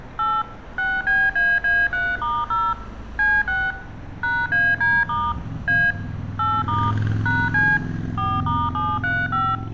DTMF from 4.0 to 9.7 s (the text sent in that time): #AD* A 8* #C 4*735